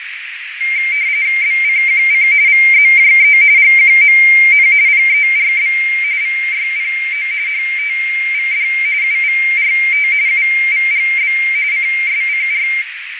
RTTY (45.45 baud, 170 Hz shift), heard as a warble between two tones, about 2200 Hz centre, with radio static, fading and a narrow filter. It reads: BCQC VZJE GQMN PERB VYPO HTVD UVRT UVGB CSCR